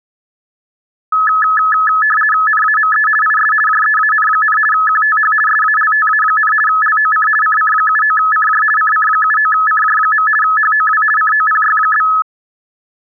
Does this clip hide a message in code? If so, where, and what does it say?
Yes: RTTY (50 baud, 450 Hz shift) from 1.1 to 12.2 s, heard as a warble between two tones, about 1500 Hz centre. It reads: NAME IS JEAN, QTH SALTA, LOC CC79CJ CC79CJ. HOW COPY?